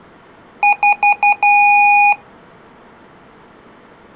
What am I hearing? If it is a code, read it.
Beep code, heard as beeps from a small speaker, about 820 Hz. 4 short, 1 long.